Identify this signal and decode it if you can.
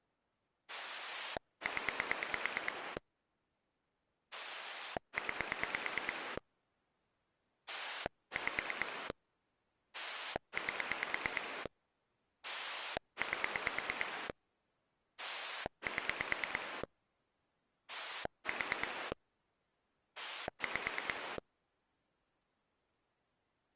Pulse dialling, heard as a rotary dial, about 9 pulses a second. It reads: 0 9 5 8 8 7 4 5